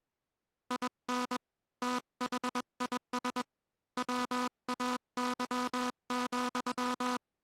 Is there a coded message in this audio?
Yes: Morse code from 0.6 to 7.2 s, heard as a buzzer, hand-sent with a paddle, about 21 wpm. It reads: IN THIS WAY,